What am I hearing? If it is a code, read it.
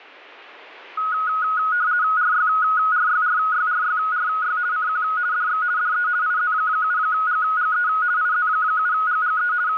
RTTY (50 baud, 170 Hz shift), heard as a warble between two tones, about 1360 Hz centre. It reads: RYRYRYRYRY CQ DX DE IZ7GGE IZ7GGE …